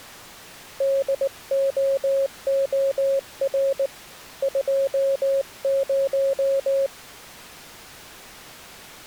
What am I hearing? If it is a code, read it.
Morse code, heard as a keyed tone, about 19 wpm, 550 Hz. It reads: DOOR 20